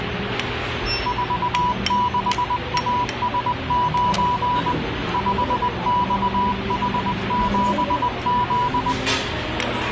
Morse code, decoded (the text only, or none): 46AS9 5XH7Z